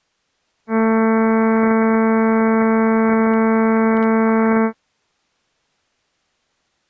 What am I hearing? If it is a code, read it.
Ship horn signal, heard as a ship's horn, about 220 Hz. 1 long. At sea: a vessel nearing a blind bend, or under power and making way in fog.